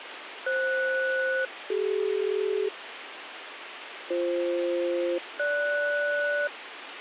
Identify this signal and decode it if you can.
Aircraft SELCAL, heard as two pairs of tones, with radio hiss and a squelch burst at the end. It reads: FS-CD BF-GS